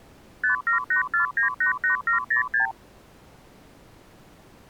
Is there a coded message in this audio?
Yes: multi-frequency trunk signalling (R2, with the far end's replies) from 0.4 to 2.7 s, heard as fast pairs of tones, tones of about 120 ms. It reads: 5784988706